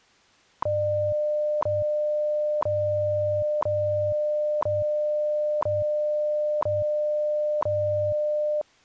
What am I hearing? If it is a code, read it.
Radio time signal (WWV, Colorado), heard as ticks, one a second.